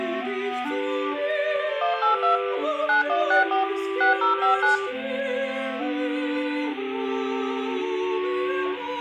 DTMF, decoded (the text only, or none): 182 9164 6059